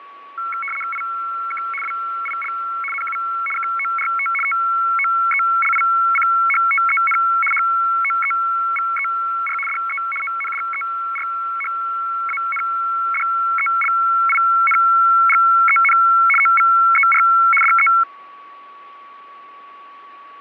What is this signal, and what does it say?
RTTY (75 baud, 850 Hz shift), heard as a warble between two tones, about 1800 Hz centre, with fading and a steady whistle near 1130 Hz. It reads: IK WIL NU KORT TOELICHTEN HOEVER DE ONDERHANDELINGEN OVER DE